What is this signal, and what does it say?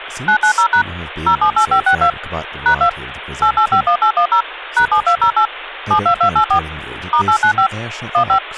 DTMF, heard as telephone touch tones, dialled by machine, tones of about 90 ms, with phone line noise and speech in English. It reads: 990# 078562 #2 8851810 #7208 72284 *895 15